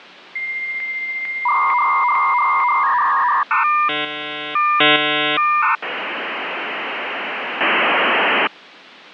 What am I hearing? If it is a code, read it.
Dial-up modem handshake (V.34 or later), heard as a whistle, warbles, then hiss.